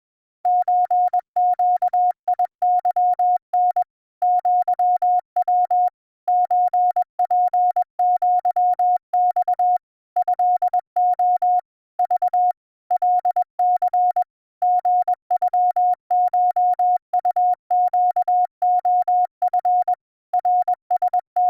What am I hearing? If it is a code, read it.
Morse code (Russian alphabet), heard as a keyed tone, machine-sent, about 21 wpm, 720 Hz. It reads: ЧЩИЫН ЪВ ЧПЪЬ ЭО Ж ЛЦ ГЮШУЩОФ …